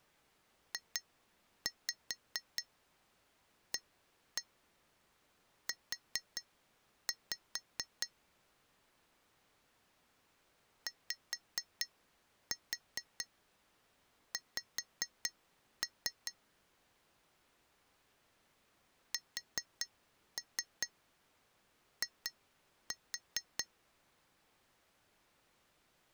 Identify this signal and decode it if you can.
Tap code, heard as taps on glass, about 4 knocks a second. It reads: JAU YX SI